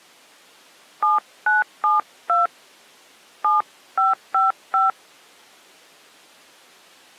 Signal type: DTMF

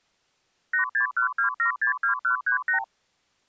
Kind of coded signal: multi-frequency trunk signalling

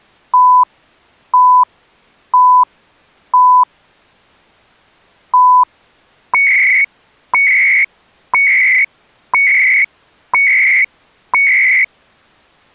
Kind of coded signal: radio time signal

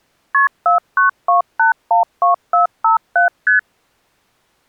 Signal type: multi-frequency trunk signalling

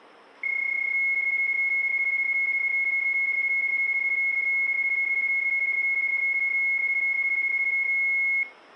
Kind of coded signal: PSK31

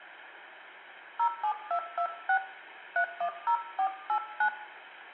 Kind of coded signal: DTMF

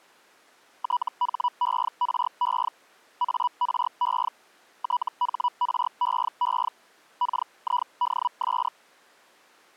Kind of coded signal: Hellschreiber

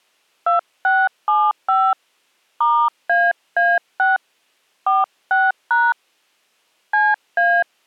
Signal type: DTMF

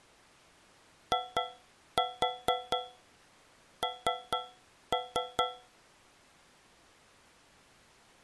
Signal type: tap code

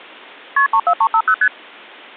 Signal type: multi-frequency trunk signalling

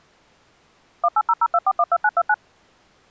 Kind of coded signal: DTMF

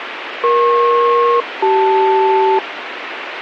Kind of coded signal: aircraft SELCAL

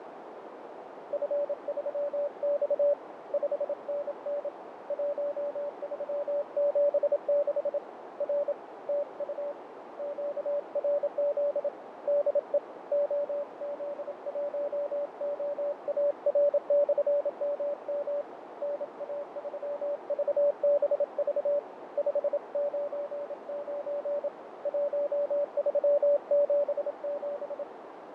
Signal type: Morse code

